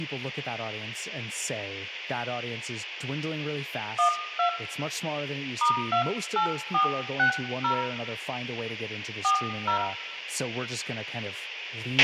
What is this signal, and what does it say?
DTMF, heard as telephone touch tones, dialled by hand, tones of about 100 ms, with a squelch burst at the end, room echo and speech in English. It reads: 12 *28460 40